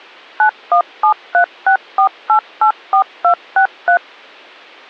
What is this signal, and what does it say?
DTMF, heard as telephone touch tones, dialled by machine, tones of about 90 ms. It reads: 917364884263